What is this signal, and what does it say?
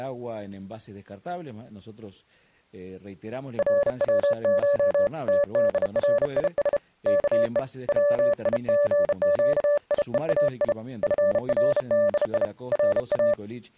Morse code (Persian alphabet), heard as a keyed tone, hand-sent with a bug key, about 32 wpm, 580 Hz. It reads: روش تدریس که ویژگیهای فردی را